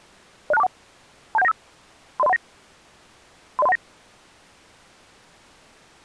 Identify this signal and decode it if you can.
Five-tone selective call (EIA), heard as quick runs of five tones, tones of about 30 ms. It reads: 06241 27195 30319 30319